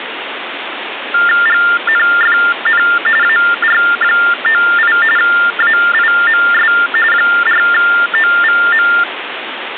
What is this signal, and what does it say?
TTY/TDD text telephone tones (45.45 baud Baudot), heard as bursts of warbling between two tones, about 400 Hz shift, 1600 Hz centre, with phone line noise. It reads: GNFN AR98 AIMS 4OVM